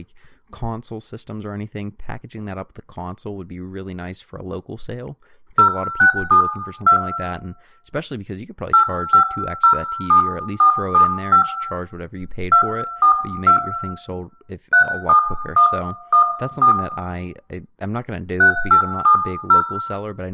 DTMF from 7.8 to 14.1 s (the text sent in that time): 8507475 242